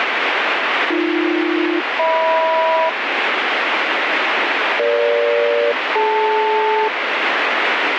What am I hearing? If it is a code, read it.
Aircraft SELCAL, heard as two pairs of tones, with radio static. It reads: AB-HM EG-DL